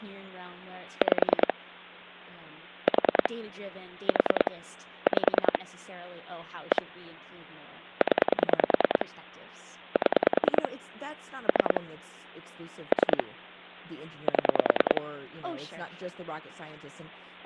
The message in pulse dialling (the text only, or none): 5 4 4 5 1 0 7 3 3 7